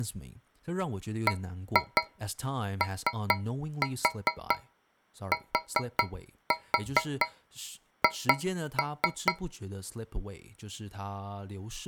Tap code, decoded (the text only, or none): BOTH